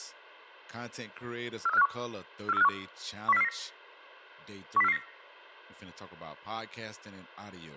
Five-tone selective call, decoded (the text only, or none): 43451 43451 10449 10449